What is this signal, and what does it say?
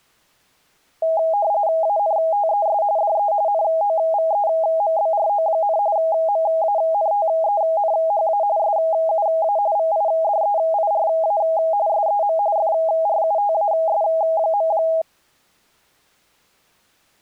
RTTY (45.45 baud, 170 Hz shift), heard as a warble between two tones, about 730 Hz centre. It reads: ANTES DE NOVEMBRO, MANTENHA SUA VIDEIRA SEM FRUTAS.